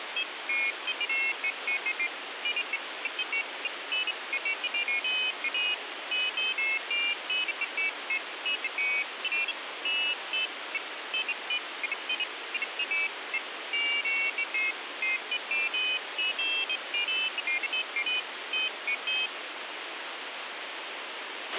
Pairs of high tones at irregular times, with radio hiss and a squelch burst at the end. There is no code.